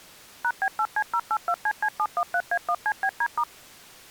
DTMF, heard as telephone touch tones, dialled by machine, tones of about 60 ms. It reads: #B8C082CC713A1CBD*